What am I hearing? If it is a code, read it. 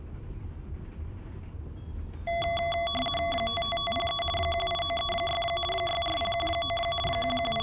RTTY (50 baud, 450 Hz shift), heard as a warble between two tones, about 910 Hz centre, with room echo and the noise inside a bus. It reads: 55503 18936 64019 …